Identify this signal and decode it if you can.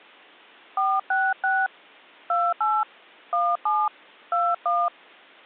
DTMF, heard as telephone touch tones, dialled by hand, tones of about 230 ms. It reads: 466 28 17 21